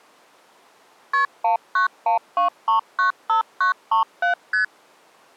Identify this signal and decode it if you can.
Multi-frequency trunk signalling (R1, as on North American trunks), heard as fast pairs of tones, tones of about 120 ms. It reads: KP 1912395937 ST